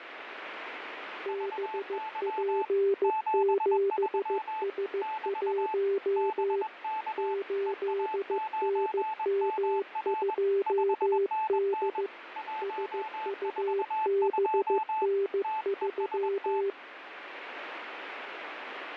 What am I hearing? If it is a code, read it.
Morse code, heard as two keyed tones, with radio static. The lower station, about 15 wpm, 400 Hz: BP7S1 8NM2D SUBN3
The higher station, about 21 wpm, 870 Hz: VY 73 <BT> BK EA9MR 5NN 142 TEST